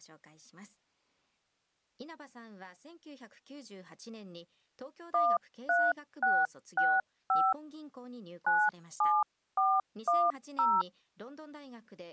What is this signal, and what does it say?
DTMF, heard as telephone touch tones, dialled by hand, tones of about 230 ms, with speech in Japanese. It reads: 13665 97410